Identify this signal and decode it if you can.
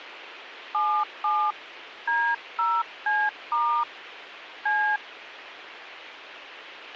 DTMF, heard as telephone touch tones, dialled by hand, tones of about 280 ms, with radio hiss and a squelch burst at the end. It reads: 77 D0C* C